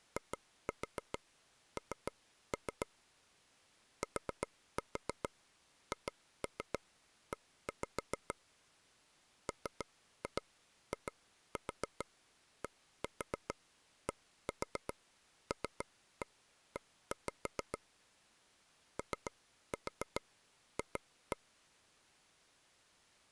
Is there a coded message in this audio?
Yes: tap code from 0.2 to 21.4 s, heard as taps on a table, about 7 knocks a second. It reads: IN THE MIDDLE OF